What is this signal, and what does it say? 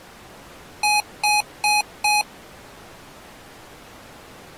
Beep code, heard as beeps from a small speaker, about 840 Hz. 4 short. In AMI BIOS tables: system timer failure; in Dell tables: memory read or write failure.